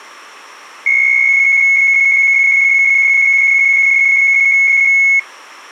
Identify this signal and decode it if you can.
PSK63 (62.5 baud), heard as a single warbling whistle, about 2200 Hz.